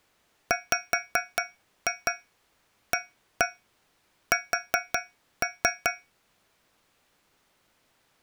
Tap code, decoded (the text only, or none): WAS